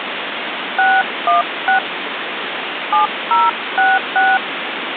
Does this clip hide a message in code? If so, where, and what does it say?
Yes: DTMF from 0.8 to 4.4 s, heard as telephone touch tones, dialled by hand, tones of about 170 ms, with phone line noise. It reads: 616 7066